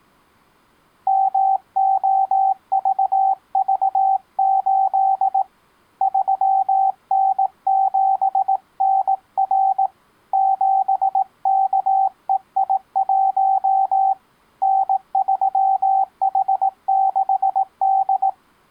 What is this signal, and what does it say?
Morse code, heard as a keyed tone, hand-sent with a paddle, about 18 wpm, 770 Hz. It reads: MOVV8 3N7NR 7KEI1 N3H6D